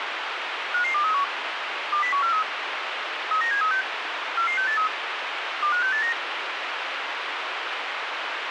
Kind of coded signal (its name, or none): five-tone selective call